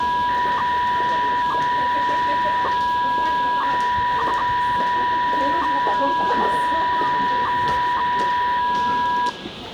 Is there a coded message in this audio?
Yes: 300-baud modem data (V.21 tones) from 0.0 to 9.3 s, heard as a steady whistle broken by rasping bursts, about 300 baud, 200 Hz shift, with phone line noise and the noise of a subway station.